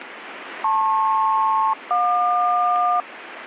Aircraft SELCAL, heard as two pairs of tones, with radio static. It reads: LP-JQ